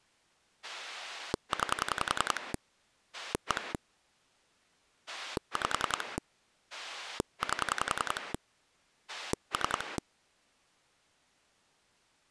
Pulse dialling, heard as a rotary dial, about 10 pulses a second. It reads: 9 1 5 8 3